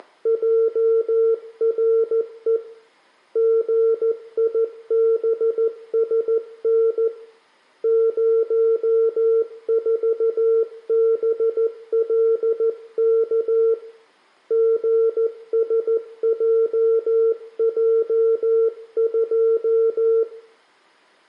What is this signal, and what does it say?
Morse code, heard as a keyed tone, hand-sent with a paddle, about 14 wpm, 450 Hz, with room echo. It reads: … GIBSN 04BLK GSJJ2